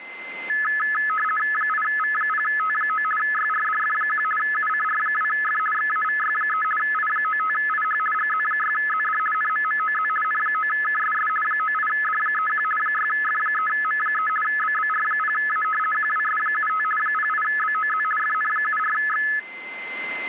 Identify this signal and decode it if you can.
RTTY (50 baud, 450 Hz shift), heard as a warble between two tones, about 1500 Hz centre, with a steady whistle near 2070 Hz. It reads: 8V0T9 YRDF1 UCR2F XAVY3 I95IH GZ6ZD NMMOZ N9KSS 98D31 6F3M3 BBR0A QWS75 08BOZ FN74X